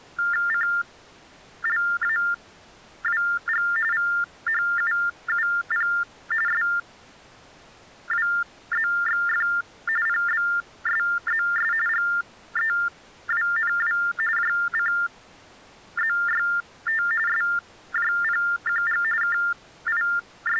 TTY/TDD text telephone tones (45.45 baud Baudot), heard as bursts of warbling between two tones, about 400 Hz shift, 1600 Hz centre. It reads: CLAWG VHUUP SWZXF PBSZS GEWNW JCZYT SJPQG …